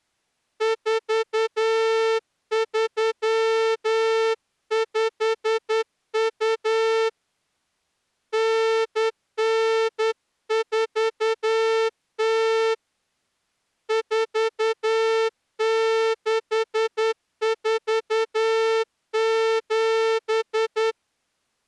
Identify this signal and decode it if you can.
Morse code (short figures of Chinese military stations), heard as a horn, hand-sent with a straight key, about 10 wpm. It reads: 4352 9940 4647